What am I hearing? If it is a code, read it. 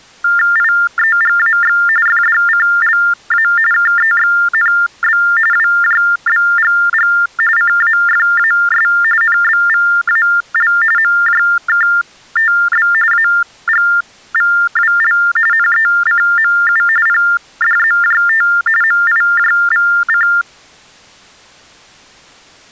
TTY/TDD text telephone tones (45.45 baud Baudot), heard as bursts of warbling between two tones, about 400 Hz shift, 1600 Hz centre. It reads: IEGAX FDCLA KEXNB WJBGG CAFAS NBVAL MJKTB AGVWL NECMU PDZJT MIJVC